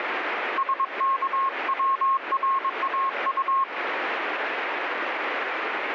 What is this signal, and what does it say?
Morse code, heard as a keyed tone, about 22 wpm, 1080 Hz, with radio static. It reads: SKWRAU